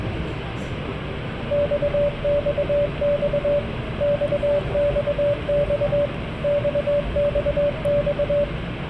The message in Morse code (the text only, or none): XXX XXX XXX